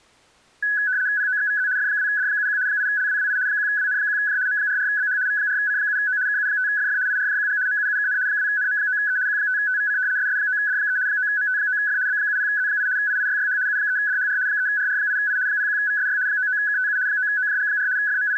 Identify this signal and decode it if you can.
RTTY (75 baud, 170 Hz shift), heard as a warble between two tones, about 1600 Hz centre. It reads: POXVZ F2D71 8LWWI 1WN1J M44BH V4C7O KU5FF IRJQG MUUKN 2NM9E Q5TVC SS9D3 9MT9F B70Z8 IIYYH U3DHR 3RR8I 01VSY 99KTU 9OJG4 …